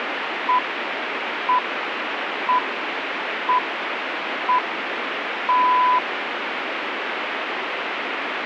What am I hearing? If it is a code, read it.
Radio time signal (six pips, as the Greenwich Time Signal), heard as pips, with radio static.